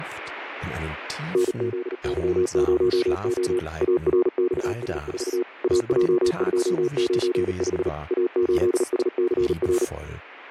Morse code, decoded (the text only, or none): NZY0O ARXS4 AJ295 A8SCR